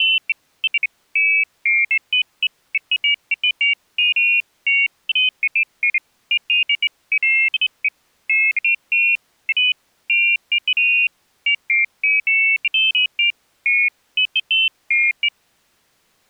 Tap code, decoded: none

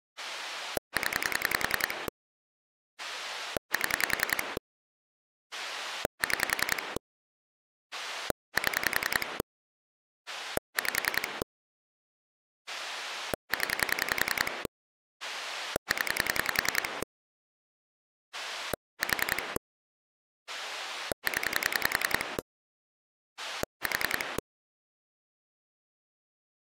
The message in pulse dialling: 0 7 6 7 5 0 0 4 0 4

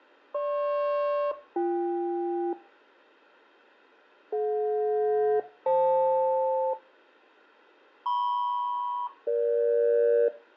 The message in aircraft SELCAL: GP-BK DJ-FL MP-EG

